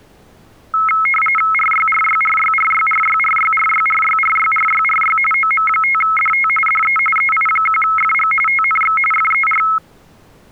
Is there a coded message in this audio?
Yes: RTTY (45.45 baud, 850 Hz shift) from 0.7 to 9.8 s, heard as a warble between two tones, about 1750 Hz centre. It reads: RYRYRYRYRYRYRYRYRYRYRY OM5DT DE EI1FG TNX FER